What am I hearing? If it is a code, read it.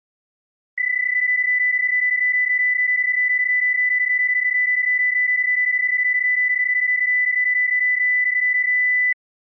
PSK31 (31.25 baud), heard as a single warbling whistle, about 2000 Hz.